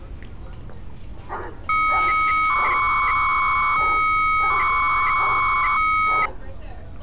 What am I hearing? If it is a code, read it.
300-baud modem data (Bell 103 tones), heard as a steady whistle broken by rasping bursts, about 300 baud, 200 Hz shift, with street noise.